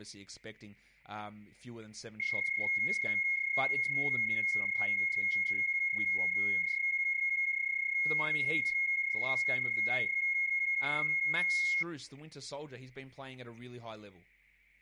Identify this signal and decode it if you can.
PSK31 (31.25 baud), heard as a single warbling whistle, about 2150 Hz, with static crashes and speech in English.